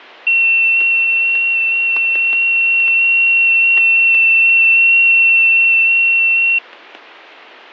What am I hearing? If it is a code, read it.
FT8 (one signal), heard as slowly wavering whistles, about 6.25 baud, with static crashes.